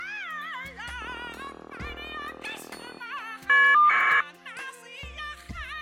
Caller ID data burst, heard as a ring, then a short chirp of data, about 1200 baud.